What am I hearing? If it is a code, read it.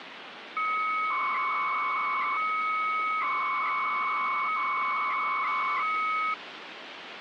300-baud modem data (Bell 103 tones), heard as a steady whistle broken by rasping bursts, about 300 baud, 200 Hz shift, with phone line noise.